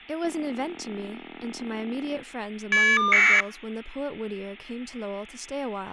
Caller ID data burst, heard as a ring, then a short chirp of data, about 1200 baud, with speech in English.